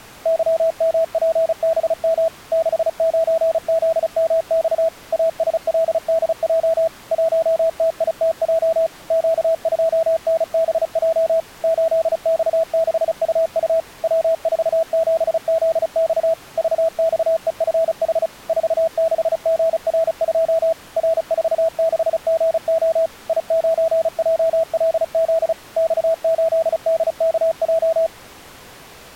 Morse code, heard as a keyed tone, machine-sent, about 35 wpm, 650 Hz. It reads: YMPBM 69ZMX ASLDJ 1TITJ Q2NBJ 8X6UU W47ZX VXEFH 46GR2 R46GO I9JLZ X8DKJ